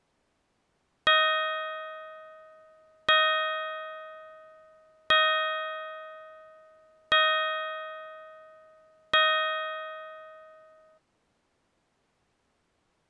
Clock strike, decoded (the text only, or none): 5